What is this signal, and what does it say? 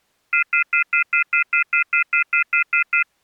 Telephone call progress tone (North American plan), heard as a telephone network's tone, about 1400, 2050, 2450, 2600 Hz, 0.1 s on and 0.1 s off. Off-hook warning tone.